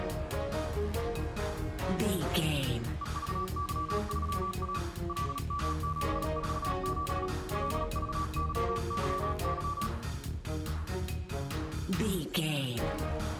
Morse code, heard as a keyed tone, hand-sent with a paddle, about 37 wpm, 1150 Hz. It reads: EVY3A LM747 LVYYY